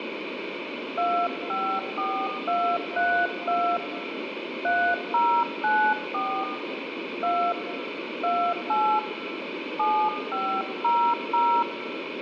DTMF, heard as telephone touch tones, dialled by hand, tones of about 300 ms, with phone line noise and room echo. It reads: 254232 3094 2 28 7500